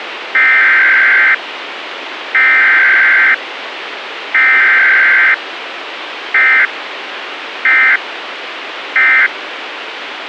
Emergency Alert System (SAME) tones (header bursts, then end-of-message bursts), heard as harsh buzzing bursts, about 520.83 baud, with radio hiss and a squelch burst at the end.